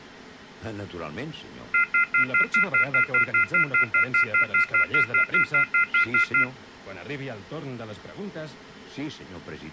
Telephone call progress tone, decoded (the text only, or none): off-hook warning tone